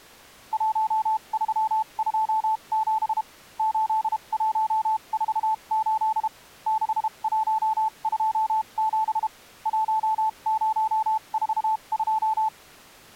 Morse code, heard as a keyed tone, machine-sent, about 32 wpm, spaced as for 27 wpm, 880 Hz. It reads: 1327 8148 6127 1042